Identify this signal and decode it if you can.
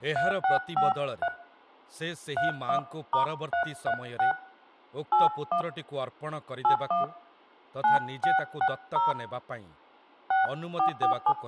DTMF, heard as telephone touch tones, dialled by hand, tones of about 110 ms, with room echo and speech in Odia. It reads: 3653 31*336 81 81 9660 6447